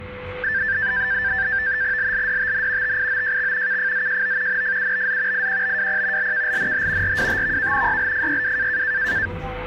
NAVTEX (SITOR-B), 100 baud, 170 Hz shift, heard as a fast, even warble, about 1650 Hz centre, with a steady whistle near 500 Hz and the noise inside a lift. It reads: LLDTN TIOJX KFZJO NFUBZ IQBWP LKLNH RWTVK YLFYW